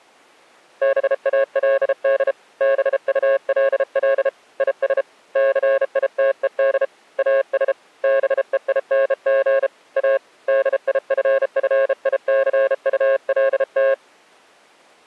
Morse code, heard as a keyed tone, hand-sent with a bug key, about 33 wpm, 540 Hz. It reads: BALD BULL IS CITED AS BEING A DIFFICULT